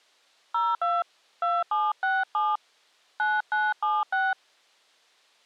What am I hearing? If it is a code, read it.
DTMF, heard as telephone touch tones, dialled by hand, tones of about 210 ms. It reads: 02 2767 9976